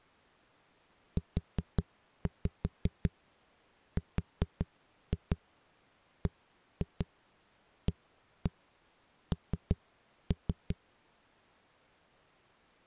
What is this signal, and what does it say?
Tap code, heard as knocks on a wall, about 5 knocks a second. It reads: URBAN